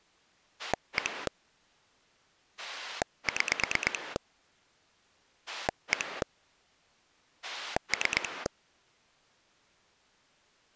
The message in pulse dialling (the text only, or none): 1 6 1 3